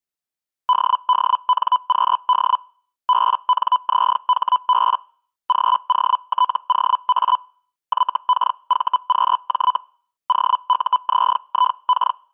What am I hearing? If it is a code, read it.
Hellschreiber (Feld-Hell, 122.5 baud), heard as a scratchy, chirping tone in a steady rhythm, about 1000 Hz. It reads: DDNQD BNZHB GOTOA YKVQJ OUZIK